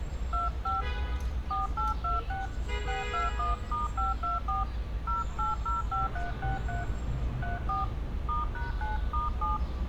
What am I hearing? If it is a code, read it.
DTMF, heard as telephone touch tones, dialled by hand, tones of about 160 ms, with street noise. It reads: 25 4826 621*524 0805363 34 *#9*7